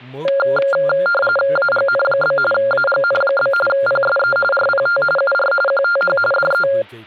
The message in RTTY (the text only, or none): AGN? AGN? PSE RPT UR QTH DE